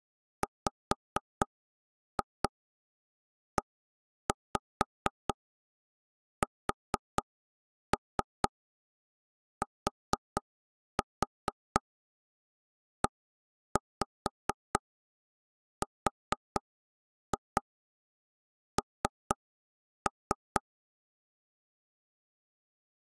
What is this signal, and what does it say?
Tap code, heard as knocks on wood, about 4 knocks a second. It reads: WESTERN